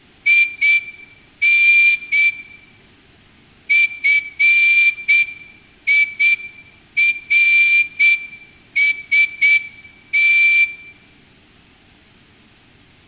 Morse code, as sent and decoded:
.. -. / ..-. .. .-. ... -
IN FIRST

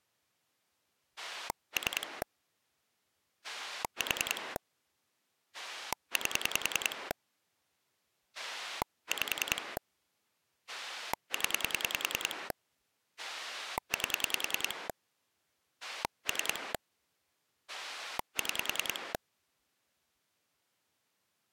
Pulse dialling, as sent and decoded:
3 / 4 / 8 / 5 / 10 / 8 / 3 / 6
3 4 8 5 0 8 3 6

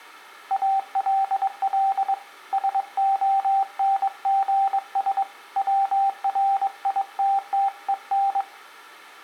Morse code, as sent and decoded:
.- .-.. .-.. / ... --- -. --. ... / .-- .-. .. - - . -.
ALL SONGS WRITTEN

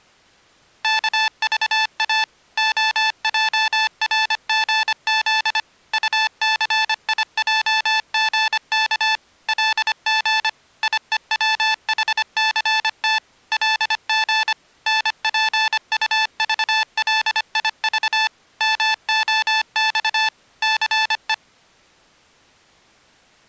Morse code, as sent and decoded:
-.- ...- .- / --- .--- .-. --. --.. / ..- -.-. .. .--- --. -.- / .-.. --. / .. . .-- .... -.-. - / .-.. --. / -. .--. ..- ...- .-.. .. ...- / -- --- -..- / -.-. .
KVA OJRGZ UCIJGK LG IEWHCT LG NPUVLIV MOX CE

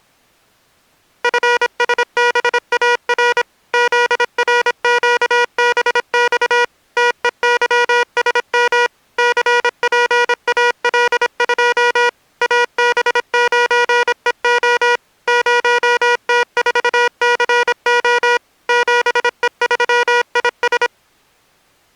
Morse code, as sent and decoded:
..-. ... -... .- .-. / --.. .-. --.- -... -..- / - . -.-- ... -- / -.-. .--. .- .-.. ..--- / .- -... ----. . --- / ----- - ....- -.-. --- / --... . ...-- .. ...
FSBAR ZRQBX TEYSM CPAL2 AB9EO 0T4CO 7E3IS

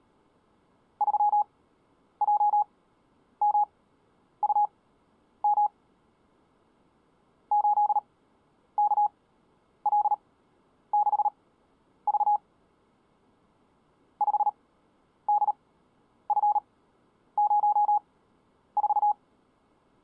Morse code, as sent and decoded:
...-- .--- -- ..- -- / ---.. -.- .-.. -.... ...- / ..... -.. ..-. ----- ....-
3JMUM 8KL6V 5DF04

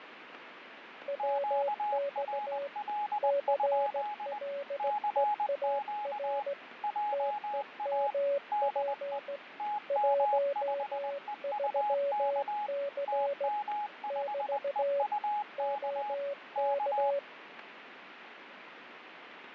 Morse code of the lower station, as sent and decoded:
.-- -..- / -.-. .-.. . .- .-. / - . -- .--. / .---- ...-- -.-. / -...- / --- -.-
WX CLEAR TEMP 13C <BT> OK

